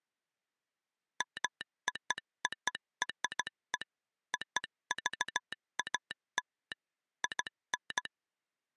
Morse code (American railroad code), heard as a telegraph sounder, machine-sent. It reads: MOORE OVAL IN